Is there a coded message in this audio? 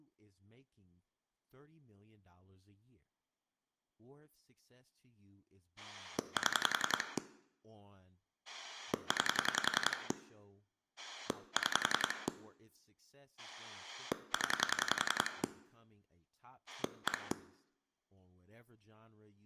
Yes: pulse dialling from 5.8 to 17.3 s, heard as a rotary dial, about 10 pulses a second, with speech in English. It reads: 7 9 6 0 1